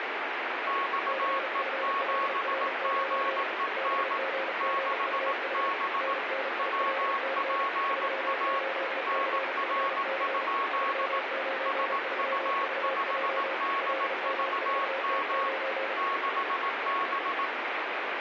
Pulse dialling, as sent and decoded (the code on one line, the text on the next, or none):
none